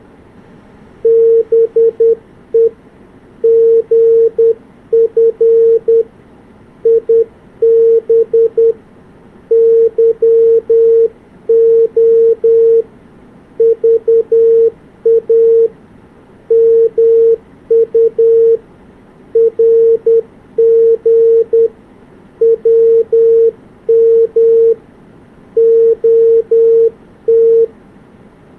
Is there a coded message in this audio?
Yes: Morse code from 1.0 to 27.7 s, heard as a keyed tone, hand-sent with a paddle, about 10 wpm, 460 Hz. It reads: BE GF IB YO VA MU RG WM OT